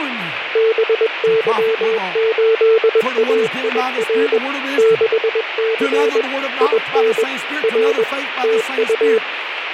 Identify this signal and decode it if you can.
Morse code, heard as a keyed tone, machine-sent, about 21 wpm, 450 Hz, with radio static and speech in English. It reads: BY8AIR 6C IN R TU